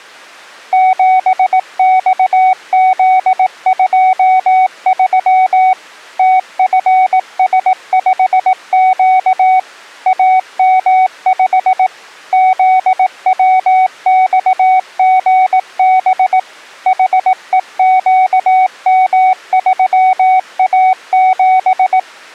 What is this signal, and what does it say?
Morse code, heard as a keyed tone, machine-sent, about 18 wpm, 750 Hz. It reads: 7XZ23 TFS5Q AM5 ZWXGB HEQM3A7